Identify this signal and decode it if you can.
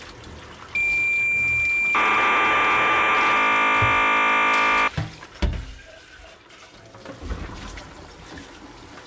Cassette data (Kansas City type), 1200 baud, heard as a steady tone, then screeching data, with kitchen noise.